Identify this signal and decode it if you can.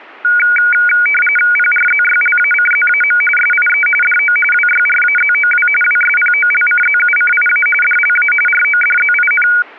RTTY (45.45 baud, 850 Hz shift), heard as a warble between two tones, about 1850 Hz centre. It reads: PRZYLACZAM SIE DO WYRAZOW WSPOLCZUCIA DLA RODZIN